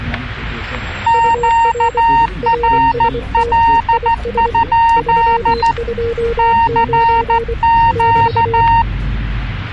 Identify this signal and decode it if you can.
Morse code, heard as two keyed tones, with static crashes and the noise inside a bus. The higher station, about 14 wpm, 920 Hz: QRL? CQ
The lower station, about 24 wpm, 470 Hz: UR RST IS 329 <BT>